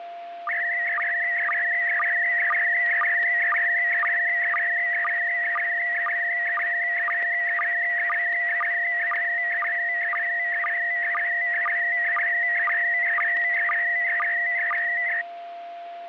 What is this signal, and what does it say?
SSTV (slow-scan television), PD 120, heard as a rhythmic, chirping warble, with static crashes and a steady whistle near 690 Hz.